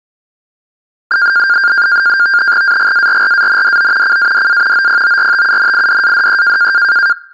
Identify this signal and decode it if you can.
NAVTEX (SITOR-B), 100 baud, 170 Hz shift, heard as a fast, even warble, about 1500 Hz centre. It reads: AGARRANDO CADA OPORTUNIDADE